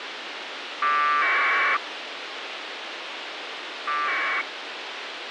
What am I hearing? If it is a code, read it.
Packet radio (AX.25, as in APRS), 1200 baud, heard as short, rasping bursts, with radio hiss.